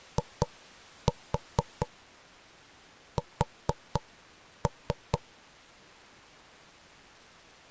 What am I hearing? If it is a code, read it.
Tap code, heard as knocks on wood, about 4 knocks a second. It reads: IS